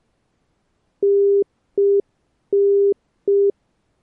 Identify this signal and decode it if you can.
Telephone call progress tone (UK plan), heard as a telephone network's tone, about 400 Hz. Congestion tone.